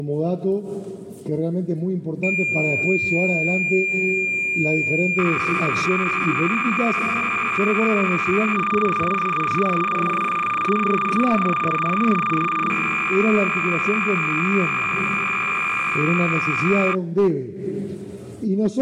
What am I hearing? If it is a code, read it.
Cassette data (Kansas City type), 300 baud, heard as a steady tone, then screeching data.